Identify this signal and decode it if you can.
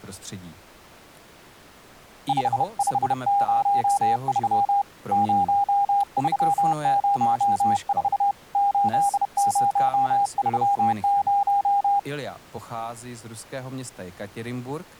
Morse code, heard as a keyed tone, hand-sent with a bug key, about 31 wpm, 800 Hz. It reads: 5503 0304 8030